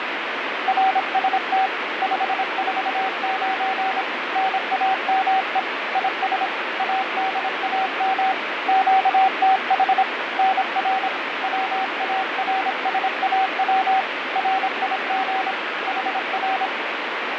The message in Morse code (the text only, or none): RST 549 NAME IS ADAM QTH NR WARSAW RIG HR